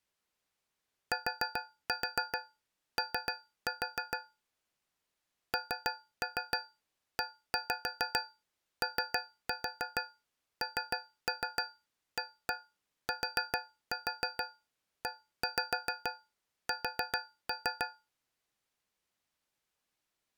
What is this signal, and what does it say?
Tap code, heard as taps on a metal pipe, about 6 knocks a second. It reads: TO NEONATES